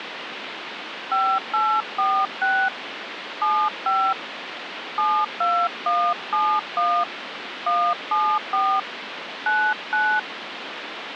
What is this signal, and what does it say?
DTMF, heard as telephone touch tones, dialled by hand, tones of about 270 ms, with phone line noise. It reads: 5846 75 72171 174 99